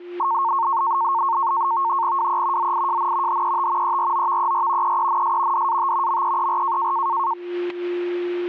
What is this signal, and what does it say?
NAVTEX (SITOR-B), 100 baud, 170 Hz shift, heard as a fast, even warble, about 1000 Hz centre, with a steady whistle near 350 Hz. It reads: WE ZIJN HET EROVER EENS DAT MEER